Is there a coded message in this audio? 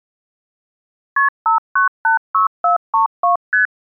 Yes: multi-frequency trunk signalling (R1, as on North American trunks) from 1.2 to 3.7 s, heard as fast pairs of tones, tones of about 120 ms. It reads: KP 5986432 ST